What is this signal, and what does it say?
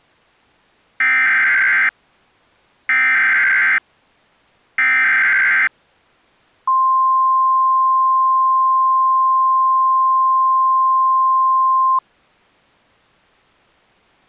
Emergency Alert System (SAME) tones (header bursts, then the 1050 Hz attention tone), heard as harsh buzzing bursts, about 520.83 baud.